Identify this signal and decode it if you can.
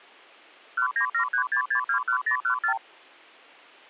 Multi-frequency trunk signalling (R2, with the far end's replies), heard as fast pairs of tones, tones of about 90 ms. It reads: 19736621014